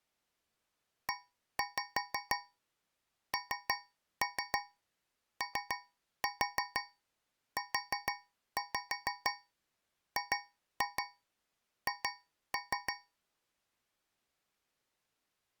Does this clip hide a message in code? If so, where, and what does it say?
Yes: tap code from 1.1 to 13.2 s, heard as taps on a metal pipe, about 6 knocks a second. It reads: ENOUGH